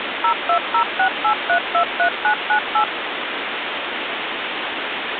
DTMF, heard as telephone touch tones, dialled by machine, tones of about 90 ms, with phone line noise. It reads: 02068323998